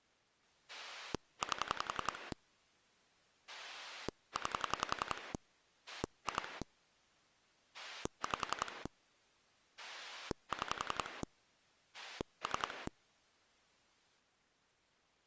Pulse dialling, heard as a rotary dial, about 11 pulses a second. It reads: 8 9 2 5 6 3